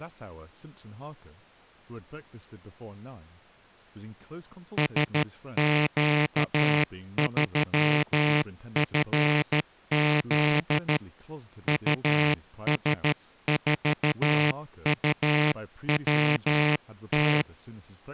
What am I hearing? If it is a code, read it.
Morse code, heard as a buzzer, hand-sent with a paddle, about 13 wpm, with speech in English. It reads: SQ3FZ US4UWT